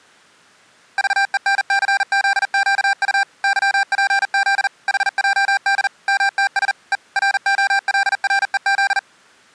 Morse code, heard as electronic beeps, machine-sent, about 40 wpm, 790 Hz. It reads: VENCZQU YPZ HJD MTS E ROLREZ